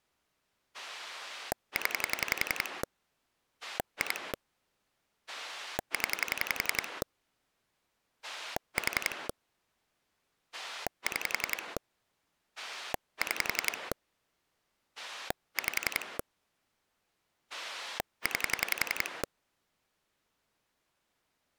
Pulse dialling, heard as a rotary dial, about 11 pulses a second. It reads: 0 2 0 4 6 6 5 9